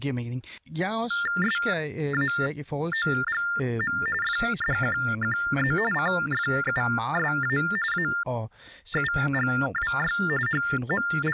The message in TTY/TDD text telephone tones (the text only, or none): SAOGM FDQQZ CFUSA AUGWY …